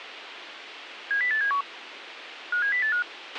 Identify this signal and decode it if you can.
Five-tone selective call (CCIR), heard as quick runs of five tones, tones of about 100 ms, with radio hiss and a squelch burst at the end. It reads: 70871 57085